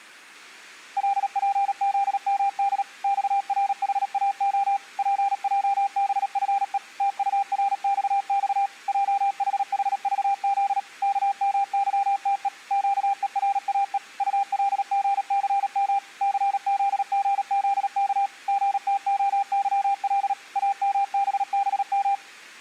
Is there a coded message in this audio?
Yes: Morse code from 0.9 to 22.2 s, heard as a keyed tone, machine-sent, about 37 wpm, 800 Hz. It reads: LPZMD XRHAO PJBFE TURXX JHHVZ KMYTE QERAE ULGCM CZGZK GTOYL AMBBM